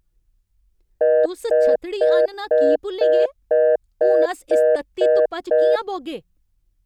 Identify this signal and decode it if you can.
Telephone call progress tone (North American plan), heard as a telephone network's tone, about 480, 620 Hz, 0.25 s on and 0.25 s off, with speech in Dogri. Congestion tone.